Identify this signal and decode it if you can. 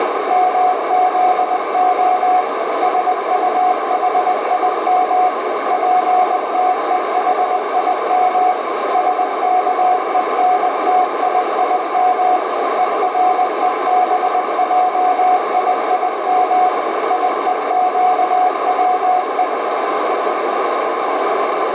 Morse code (Hebrew alphabet), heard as a keyed tone, machine-sent, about 20 wpm, 730 Hz, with heavy radio static and a narrow filter. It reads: מזה שטחים פתוחים שכונתיים ורובעיים יוקצו